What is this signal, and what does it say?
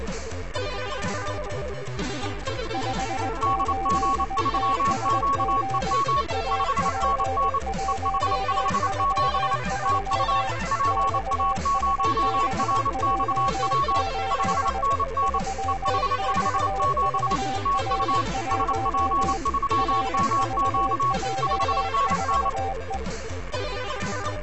Morse code, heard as two keyed tones, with static crashes. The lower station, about 20 wpm, 780 Hz: 58TSG AP143 XSBJ8 3XVR1 RVJ4E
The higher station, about 28 wpm, 1110 Hz: DG3QEM 5NN EH57 TU PA0RXW 5NN EH57 TU SP3MQ 5NN